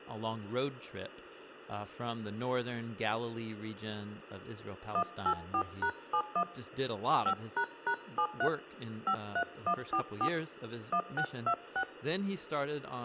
DTMF, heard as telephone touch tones, dialled by hand, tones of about 80 ms, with hum and speech in English. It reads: 184#71 5##73 53144 1626